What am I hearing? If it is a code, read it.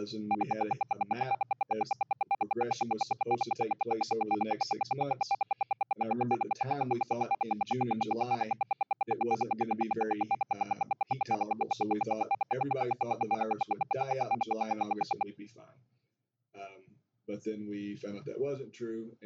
Radio time signal (RWM, Moscow), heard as ten pulses a second.